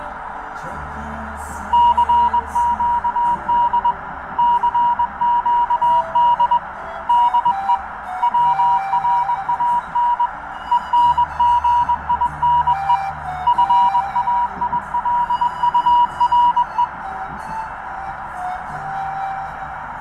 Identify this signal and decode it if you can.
Morse code, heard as a keyed tone, hand-sent with a paddle, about 21 wpm, 960 Hz, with radio static and a narrow filter. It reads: CQD CQD DE WRAN ENGINE FAILURE